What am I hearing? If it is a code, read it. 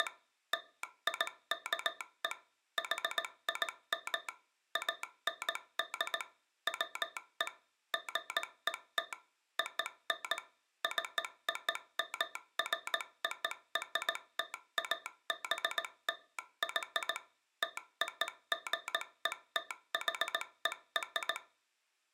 Morse code (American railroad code), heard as a telegraph sounder, machine-sent. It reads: … LIKE HIM AND WE GET ON COMFORTABLY TOGETHER